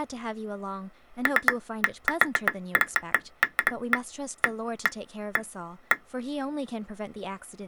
Irregular taps on glass, with speech in English. There is no code.